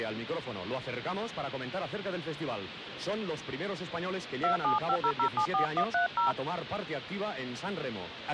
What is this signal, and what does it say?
DTMF, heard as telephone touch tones, dialled by hand, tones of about 100 ms, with phone line noise. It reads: 2750074130